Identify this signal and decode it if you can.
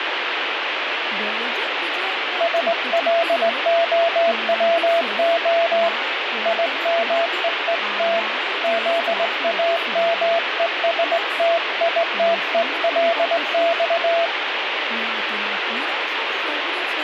Morse code (Russian alphabet), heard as a keyed tone, hand-sent with a straight key, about 19 wpm, 670 Hz, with radio static and speech in Gujarati. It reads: СЛОВО ИМЕЕТ ЗАМЕСТИТЕЛЬ